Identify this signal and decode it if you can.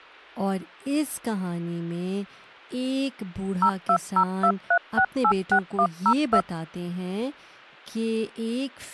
DTMF, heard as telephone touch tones, dialled by machine, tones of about 70 ms, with speech in English. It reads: 02023686102